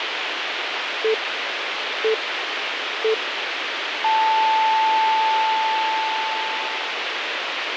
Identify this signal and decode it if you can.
Radio time signal (three low pips and a long one an octave up, as on NHK), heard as pips, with radio hiss.